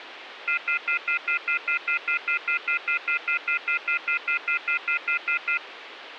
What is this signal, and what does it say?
Telephone call progress tone (North American plan), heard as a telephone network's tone, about 1400, 2050, 2450, 2600 Hz, 0.1 s on and 0.1 s off, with phone line noise. Off-hook warning tone.